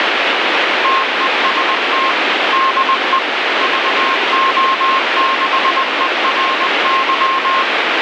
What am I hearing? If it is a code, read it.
Morse code, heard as a keyed tone, machine-sent, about 20 wpm, 1070 Hz, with heavy radio static. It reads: TEST DE VO6ERY